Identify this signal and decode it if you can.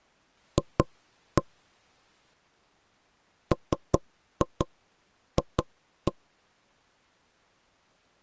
Tap code, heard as knocks on wood, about 5 knocks a second. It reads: F MF